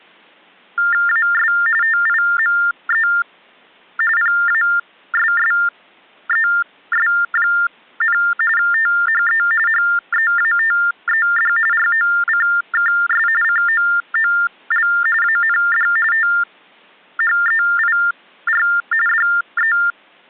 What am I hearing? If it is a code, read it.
TTY/TDD text telephone tones (45.45 baud Baudot), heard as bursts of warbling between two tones, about 400 Hz shift, 1600 Hz centre. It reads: AS TIME PASSES, THE HEATED ROCKS COOL AND THEIR …